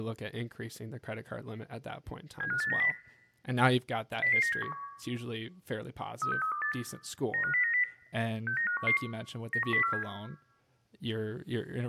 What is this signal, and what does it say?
Five-tone selective call (CCIR), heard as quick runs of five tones, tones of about 100 ms, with room echo and speech in English. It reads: 75890 00971 36328 95090 69511 91047